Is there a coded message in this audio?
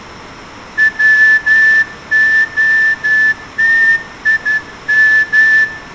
Yes: Morse code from 0.7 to 5.7 s, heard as a whistle, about 11 wpm, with room echo. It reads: WOTIM